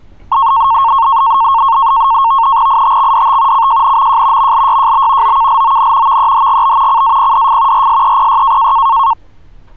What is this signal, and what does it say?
NAVTEX (SITOR-B), 100 baud, 170 Hz shift, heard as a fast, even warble, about 1000 Hz centre, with street noise. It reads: ITXDT CJNMJ MLYJB OKLON VEHGB CAPDF RSEPY